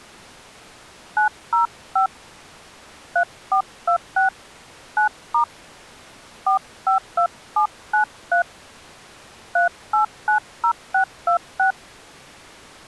DTMF, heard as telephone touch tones, dialled by hand, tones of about 110 ms. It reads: 905 3426 9* 452793 3890626